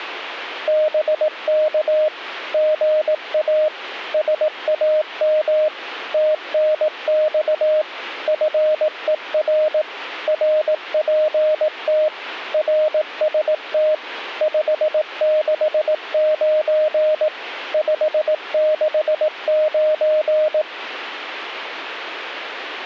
Morse code, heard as a keyed tone, machine-sent, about 18 wpm, 620 Hz. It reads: BK GA SAM TNX FER RPT RST 569 569